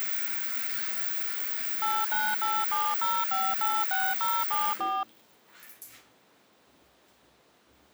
DTMF, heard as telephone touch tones, dialled by machine, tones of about 230 ms, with the noise of a restroom. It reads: 89870586074